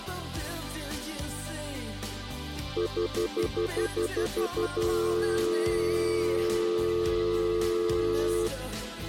Telephone call progress tone (North American plan), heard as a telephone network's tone, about 350, 440 Hz, 0.1 s on and 0.1 s off. Stutter dial tone.